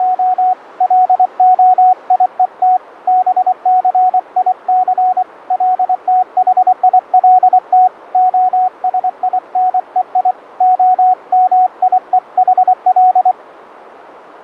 Morse code (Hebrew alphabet), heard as a keyed tone, hand-sent with a paddle, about 24 wpm, 740 Hz. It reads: … להיות בסיס לתחילת השינוי המיוחל